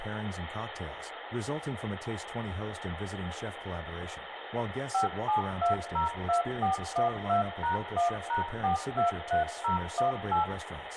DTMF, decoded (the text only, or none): 57202412#1#423018